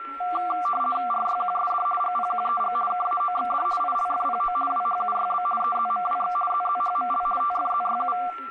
RTTY (50 baud, 450 Hz shift), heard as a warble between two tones, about 940 Hz centre, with static crashes, a steady whistle near 1350 Hz and speech in English. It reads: RYQSD GPQEG KAOXD ILFPO WHUYB EZMWX ZZHML TFZYU